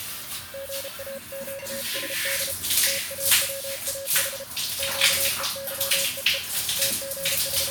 Morse code (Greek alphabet), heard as a keyed tone, hand-sent with a paddle, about 33 wpm, 550 Hz, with the noise of a restroom. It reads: ΓΑΨΣΔ ΤΑΩΑΗ ΨΕΥΕΕ …